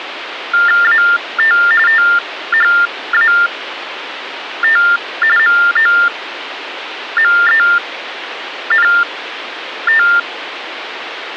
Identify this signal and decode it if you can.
TTY/TDD text telephone tones (45.45 baud Baudot), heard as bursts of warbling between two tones, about 400 Hz shift, 1600 Hz centre, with phone line noise. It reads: AT THAT MOMENT